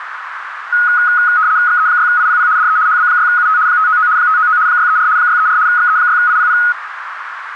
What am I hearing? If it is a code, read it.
RTTY (75 baud, 170 Hz shift), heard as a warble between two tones, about 1360 Hz centre, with radio static and a narrow filter. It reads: XE6IPP DE HB6UT 599 599 634 634 XE6IPP